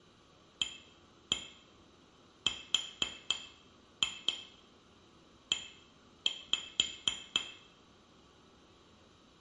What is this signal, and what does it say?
Tap code, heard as taps on glass, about 4 knocks a second, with room echo. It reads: ARE